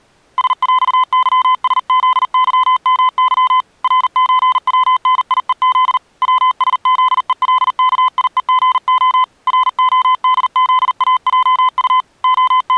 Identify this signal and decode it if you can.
Morse code (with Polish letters), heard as a keyed tone, hand-sent with a paddle, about 40 wpm, 1020 Hz. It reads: SŁYSZYMY RÓWNIEZ WSZELKIEGO RODZAJU …